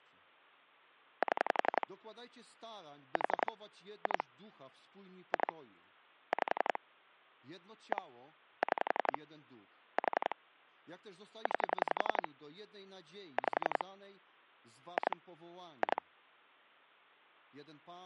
Pulse dialling, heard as clicks on a phone line, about 11 pulses a second, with speech in Polish. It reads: 7 4 2 2 5 1 6 4 9 5 2 2